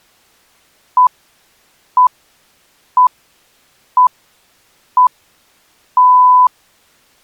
Radio time signal (six pips, as the Greenwich Time Signal), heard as pips.